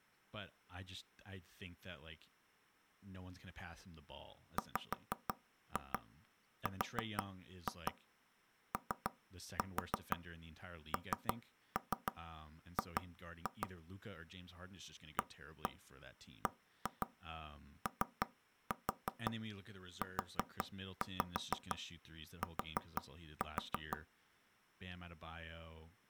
Tap code, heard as knocks on wood, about 6 knocks a second, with speech in English. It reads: WRONG ABOUT